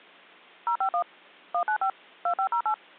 DTMF, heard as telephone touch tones, dialled by machine, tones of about 90 ms. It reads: 051 195 2508